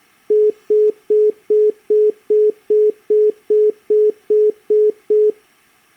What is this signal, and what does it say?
Telephone call progress tone (single-tone plan, as in most of Europe), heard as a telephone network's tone, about 420 Hz, 0.2 s on and 0.2 s off. Congestion tone.